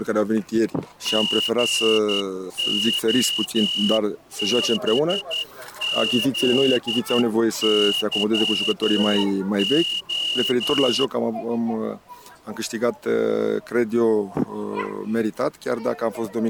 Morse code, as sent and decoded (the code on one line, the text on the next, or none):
--. --- -... --.. -.-- ---
GOBZYO